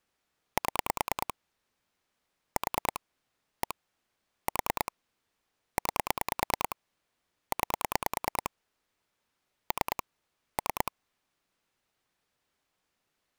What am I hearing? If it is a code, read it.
Pulse dialling, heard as clicks on a phone line, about 9 pulses a second. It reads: 7 4 1 4 9 9 3 3